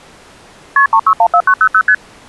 Multi-frequency trunk signalling (R1, as on North American trunks), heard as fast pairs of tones, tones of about 70 ms. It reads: KP 3614900 ST